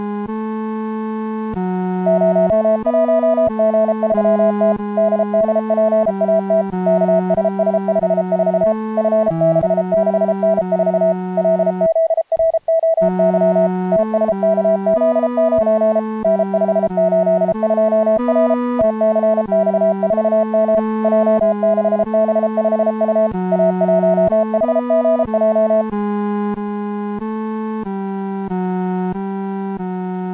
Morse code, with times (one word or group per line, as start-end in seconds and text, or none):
2.1-4.7 01G3T
5.0-6.6 DDPAT
6.9-8.7 KSS54
9.0-11.1 F66N4
11.4-13.7 LZROY
13.9-16.0 TSKZ9
16.2-18.5 N582R
18.8-20.8 TCX4M
21.0-23.3 J6B5U
23.5-25.8 A1HGJ